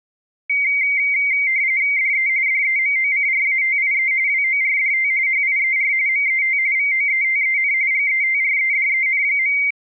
RTTY (45.45 baud, 170 Hz shift), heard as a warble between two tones, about 2200 Hz centre. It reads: DE DEMOCRATIE WORDT HIER MET VOETEN GETREDEN.